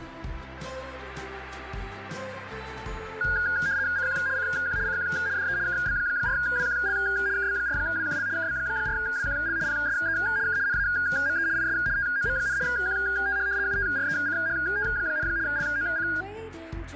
RTTY (75 baud, 170 Hz shift), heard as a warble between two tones, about 1550 Hz centre. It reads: CQ CQ CQ DE KB4WQL KB4WQL KB4WQL PSE K NAME IS TOM, QTH UTRECHT, LOC